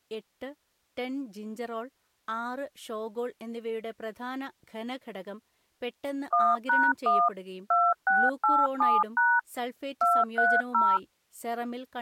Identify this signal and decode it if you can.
DTMF, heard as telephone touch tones, dialled by machine, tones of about 230 ms, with speech in Malayalam. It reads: 1#1 2687# 230